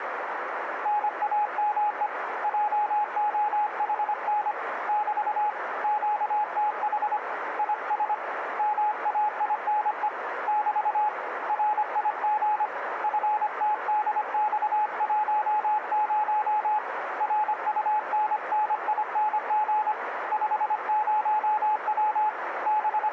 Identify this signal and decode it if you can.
Morse code, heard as a keyed tone, hand-sent with a paddle, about 25 wpm, 850 Hz, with radio static, a narrow filter and room echo. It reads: NAME JOHN <BT> QTH IS MAINE <BT> RIG FTDX10 RUNNING 50W …